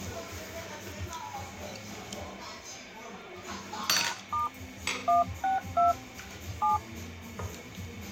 DTMF, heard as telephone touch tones, dialled by hand, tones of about 150 ms, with the noise of a restaurant. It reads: #* 162 7